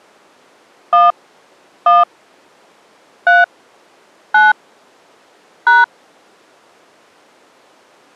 DTMF, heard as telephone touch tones, dialled by hand, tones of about 180 ms. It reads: 1 1 3 9 #